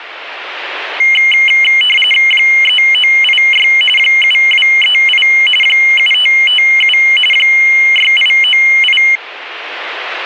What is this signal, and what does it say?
RTTY (45.45 baud, 850 Hz shift), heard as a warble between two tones, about 2550 Hz centre. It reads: 3986 7238 7557 6898